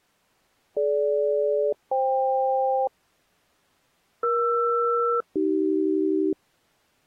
Aircraft SELCAL, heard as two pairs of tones. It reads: DG-FK ER-AC